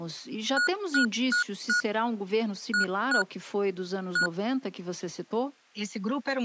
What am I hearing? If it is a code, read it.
Beep code, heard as beeps from a small speaker, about 1450 Hz, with speech in Portuguese. 4-2-1. In Phoenix BIOS tables: timer tick failure.